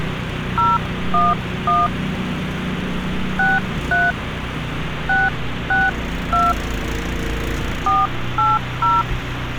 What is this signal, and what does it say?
DTMF, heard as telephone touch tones, dialled by hand, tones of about 190 ms, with phone line noise and street noise. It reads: 011 63 662 480